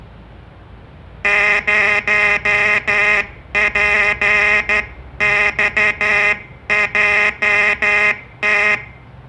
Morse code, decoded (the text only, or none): 0PXJT